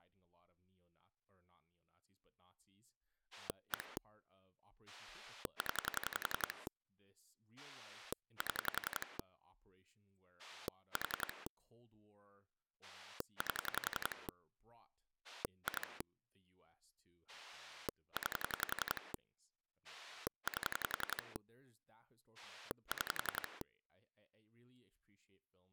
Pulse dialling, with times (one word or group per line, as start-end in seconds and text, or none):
3.3-4.0 1
4.9-6.7 0
7.6-9.2 7
10.4-11.5 4
12.8-14.3 8
15.2-16.0 2
17.3-19.1 9
19.8-21.4 8
22.4-23.6 6